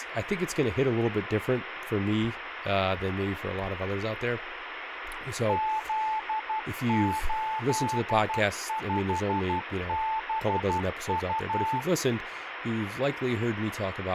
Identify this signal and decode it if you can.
Morse code, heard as a keyed tone, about 12 wpm, 880 Hz, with radio static and speech in English. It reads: Z85BU